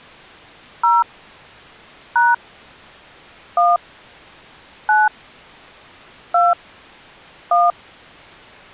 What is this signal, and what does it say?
DTMF, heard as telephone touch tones, dialled by hand, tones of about 190 ms. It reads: 0 # 1 9 2 1